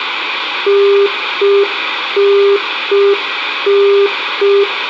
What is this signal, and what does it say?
Telephone call progress tone (UK plan), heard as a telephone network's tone, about 400 Hz, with phone line noise and room echo. Congestion tone.